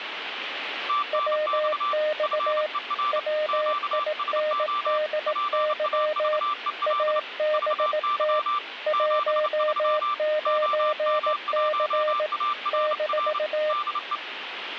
Morse code, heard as two keyed tones, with radio static. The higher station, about 29 wpm, 1180 Hz: TNX FER QSO PAVEL VY 73 OM1ARR DE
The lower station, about 18 wpm, 610 Hz: WX WINDY ABT 19C -